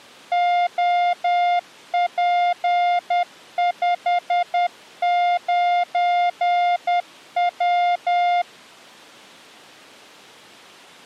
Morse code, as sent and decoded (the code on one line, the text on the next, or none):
--- .--. ..... ----. .--
OP59W